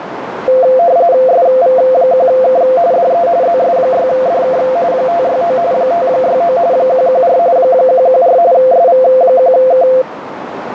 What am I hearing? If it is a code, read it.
RTTY (45.45 baud, 170 Hz shift), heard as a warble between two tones, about 600 Hz centre, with radio static and a narrow filter. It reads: SV1K DE ZS6DK 569 569 114 114 SV1K